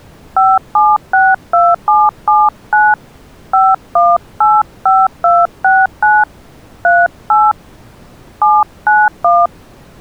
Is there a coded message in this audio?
Yes: DTMF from 0.4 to 9.5 s, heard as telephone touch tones, dialled by hand, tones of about 210 ms. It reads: 5762779 5185269 38 791